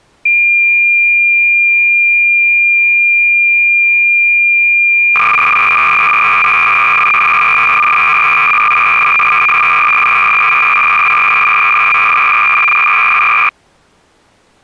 Cassette data (Kansas City type), 300 baud, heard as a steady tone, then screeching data.